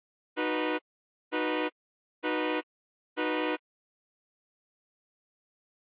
Train horn signal, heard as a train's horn. 4 short. On North American railways: a request for a signal to be given or repeated.